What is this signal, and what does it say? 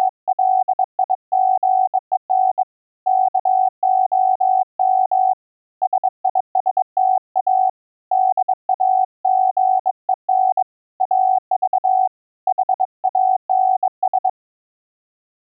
Morse code (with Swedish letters), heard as a keyed tone, hand-sent with a bug key, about 22 wpm, 750 Hz. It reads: … KOM SISTA DAGEN AV HANS